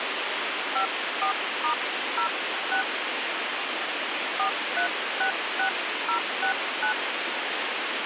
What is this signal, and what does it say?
DTMF, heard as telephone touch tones, dialled by hand, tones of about 100 ms, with radio hiss. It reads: 54*06 4366069